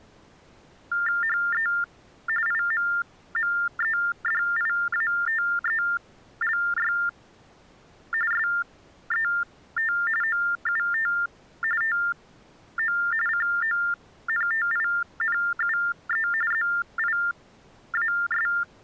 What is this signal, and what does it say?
TTY/TDD text telephone tones (45.45 baud Baudot), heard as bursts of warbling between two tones, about 400 Hz shift, 1600 Hz centre. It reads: HE IMMEDIATELY SET OUT TO CONTINUE ZIAS